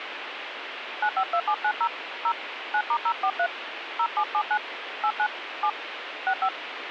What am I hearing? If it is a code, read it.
DTMF, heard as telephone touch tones, dialled by hand, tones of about 70 ms, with radio hiss. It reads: 952790 0 9*043 0779 89 7 65